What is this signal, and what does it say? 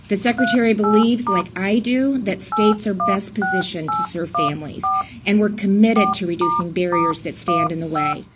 DTMF, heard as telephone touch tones, dialled by hand, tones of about 170 ms. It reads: 38* 816814 4**15